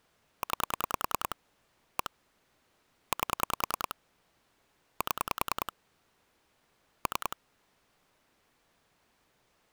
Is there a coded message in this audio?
Yes: pulse dialling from 0.4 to 7.3 s, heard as clicks on a phone line, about 10 pulses a second. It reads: 9 1 8 7 3